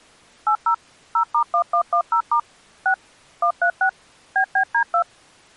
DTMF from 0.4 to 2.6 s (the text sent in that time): 80 0*1110*